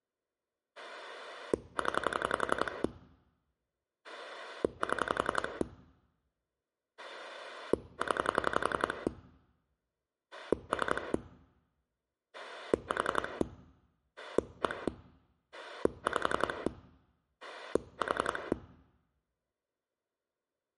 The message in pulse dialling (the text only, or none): 0 7 0 3 4 1 5 4